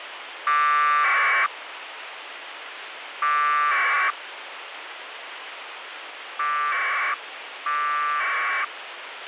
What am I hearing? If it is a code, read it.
Packet radio (AX.25, as in APRS), 1200 baud, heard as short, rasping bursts, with radio hiss and a squelch burst at the end.